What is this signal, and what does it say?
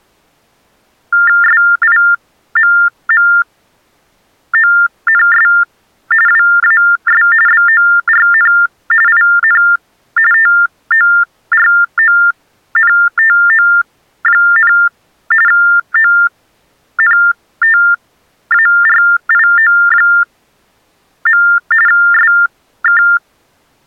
TTY/TDD text telephone tones (45.45 baud Baudot), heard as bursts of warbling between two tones, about 400 Hz shift, 1600 Hz centre. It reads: SIMMONS WAS BORN IN TORONTO, ONTARIO. SK